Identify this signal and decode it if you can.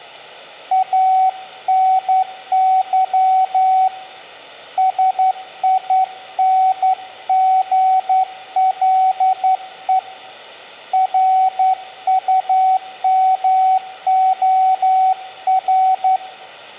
Morse code, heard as a keyed tone, hand-sent with a straight key, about 11 wpm, 760 Hz, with room echo. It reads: ANY SINGLE RUMOR